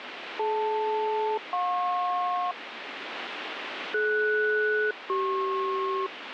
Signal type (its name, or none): aircraft SELCAL